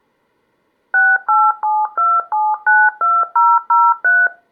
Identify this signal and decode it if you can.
DTMF, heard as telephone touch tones, dialled by machine, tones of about 220 ms. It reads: 6872792003